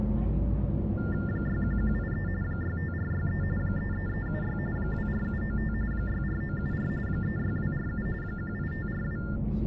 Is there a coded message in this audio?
Yes: TTY/TDD text telephone tones (45.45 baud Baudot) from 1.0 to 9.4 s, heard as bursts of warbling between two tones, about 400 Hz shift, 1600 Hz centre, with the noise inside a bus. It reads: 61183 65463 33376 24795 64974 36247 18542